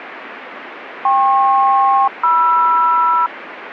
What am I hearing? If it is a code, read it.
Aircraft SELCAL, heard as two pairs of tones, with radio static. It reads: KP-MR